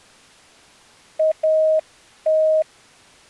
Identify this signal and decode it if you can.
Morse code, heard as a keyed tone, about 10 wpm, 630 Hz. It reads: AT